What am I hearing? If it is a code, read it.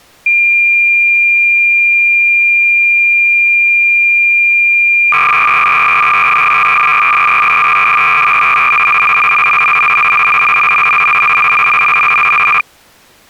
Cassette data (Kansas City type), 300 baud, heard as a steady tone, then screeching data.